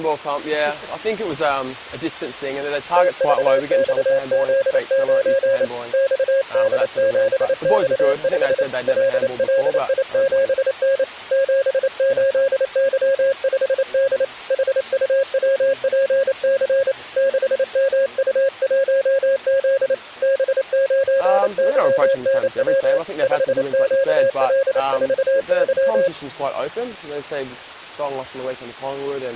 Morse code, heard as a keyed tone, hand-sent with a paddle, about 28 wpm, 540 Hz. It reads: TVXZ9 XD7X5 LLI7N 78Y5D HUWPC 6MU1Z B9YNW 5QL4Y